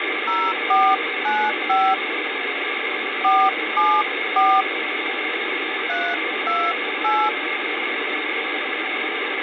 DTMF, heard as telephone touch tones, dialled by hand, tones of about 250 ms, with phone line noise. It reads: 0495 474 328